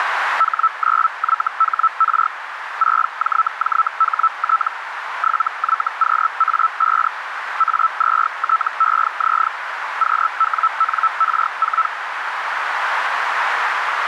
Hellschreiber (Feld-Hell, 122.5 baud), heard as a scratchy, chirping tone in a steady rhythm, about 1320 Hz, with radio static and a narrow filter. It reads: H9YHR 6JJHT 7YQA5 A2TEZ QWNR4